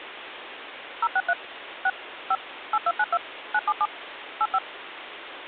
DTMF, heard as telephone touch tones, dialled by machine, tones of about 50 ms, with phone line noise. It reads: 063 6 5 8292 977 85